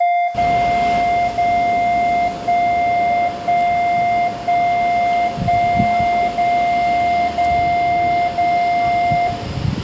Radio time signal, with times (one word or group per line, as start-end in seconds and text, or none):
0.3-1.3 0
1.3-2.3 0
2.3-3.3 1
3.3-4.3 1
4.3-5.3 1
5.3-6.3 1
6.3-7.3 0
7.3-8.3 0
8.3-9.3 0